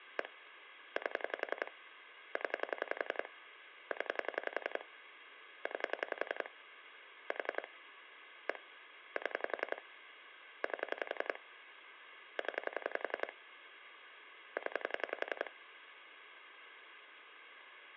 Pulse dialling, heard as clicks on a phone line, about 11 pulses a second. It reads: 1 8 0 0 9 4 1 7 8 0 0